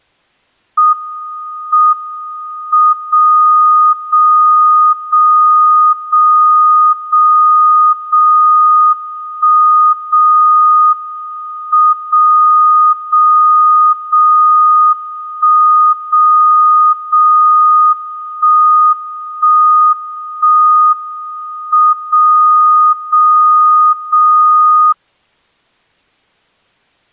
Radio time signal (WWVB), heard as a tone whose level steps once a second, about 1240 Hz. The time is 17:02 UTC. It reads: M M 0 0 0 0 0 0 1 0 M 0 0 0 1 0 0 1 1 1 M 0 0 0